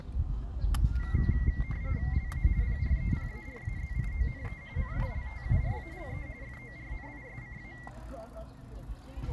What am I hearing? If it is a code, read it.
RTTY (45.45 baud, 170 Hz shift), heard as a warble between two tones, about 2050 Hz centre, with the noise of a park. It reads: LA PREPARAZIONE CULTURALE FORNISCA